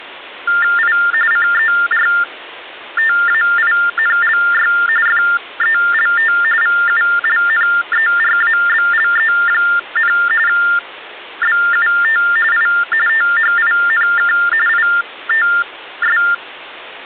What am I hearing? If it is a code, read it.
TTY/TDD text telephone tones (45.45 baud Baudot), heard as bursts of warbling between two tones, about 400 Hz shift, 1600 Hz centre. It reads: I CERTAINLY FELT VULNERABLE, BUT I THINK ITS